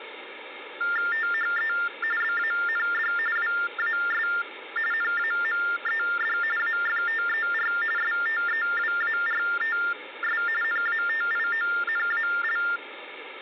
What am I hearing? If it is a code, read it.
TTY/TDD text telephone tones (45.45 baud Baudot), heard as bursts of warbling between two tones, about 400 Hz shift, 1600 Hz centre, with phone line noise. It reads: THE BAND WAS NAMED AFTER STEWARTS NATIONAL